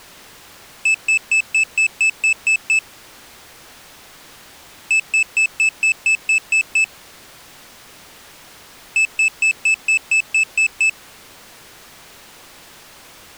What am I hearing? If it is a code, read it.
Beep code, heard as a piezo beeper, played three times, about 2600 Hz. 9 short. In AMI BIOS tables: ROM checksum failure.